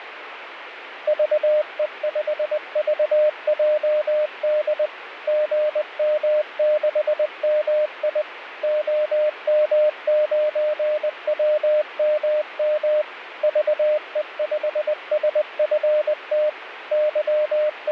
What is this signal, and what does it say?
Morse code, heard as a keyed tone, machine-sent, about 20 wpm, 610 Hz, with radio static. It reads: VE5VJD GM6MI OM9WMM VE5SFT …